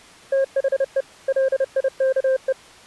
Morse code, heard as a keyed tone, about 30 wpm, 530 Hz. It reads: THE LIKE